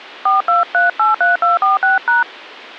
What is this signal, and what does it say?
DTMF, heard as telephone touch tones, dialled by hand, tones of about 150 ms. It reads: 42383246#